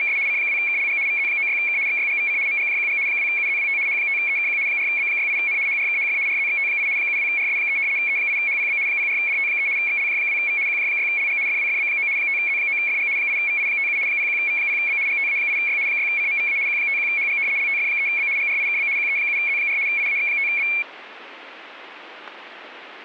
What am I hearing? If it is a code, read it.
RTTY (75 baud, 170 Hz shift), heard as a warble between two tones, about 2300 Hz centre. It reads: … C2KLG VZ96K XYGVC MGJQG 2UZWT H5EKQ 4B68N HRKHF RZXT8 72RS3 E8HPB 04DT3 XLJ2V QJ6LG FWFB9 5Z9FG 8VI57 01V0B GTA8Y 6CMVA Q51HG LTF3B GRIKB QE7Z4 IAX5B